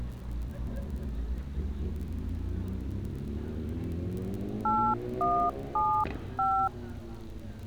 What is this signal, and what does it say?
DTMF, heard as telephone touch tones, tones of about 290 ms, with street noise. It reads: 8175